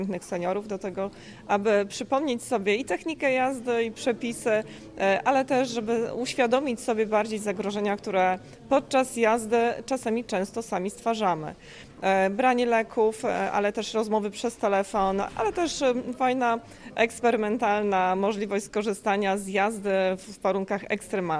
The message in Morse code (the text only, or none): none